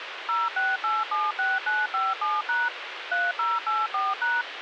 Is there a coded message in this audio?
Yes: DTMF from 0.3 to 4.4 s, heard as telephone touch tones, dialled by machine, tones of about 200 ms, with radio hiss. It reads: 06876957# 3084#